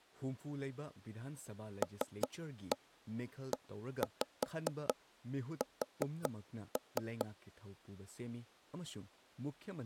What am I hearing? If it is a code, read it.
Tap code, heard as taps on a table, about 5 knocks a second, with speech in Manipuri. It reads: LES